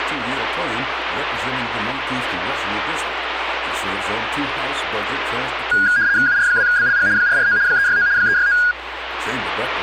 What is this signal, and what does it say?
RTTY (75 baud, 170 Hz shift), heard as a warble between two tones, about 1550 Hz centre. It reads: UR2BLG 449 369 369